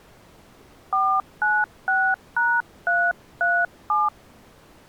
DTMF, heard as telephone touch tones, dialled by hand, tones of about 230 ms. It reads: 496#337